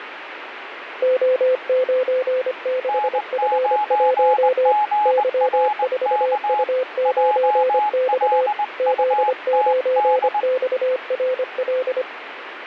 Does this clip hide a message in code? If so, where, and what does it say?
Yes: Morse code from 1.0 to 12.1 s, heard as two keyed tones, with radio static. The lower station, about 25 wpm, 510 Hz: O96F1 Y4U9X Z9XRL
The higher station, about 20 wpm, 840 Hz: N9GRK JLUTD